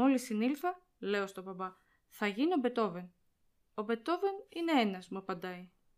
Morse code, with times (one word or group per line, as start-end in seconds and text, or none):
none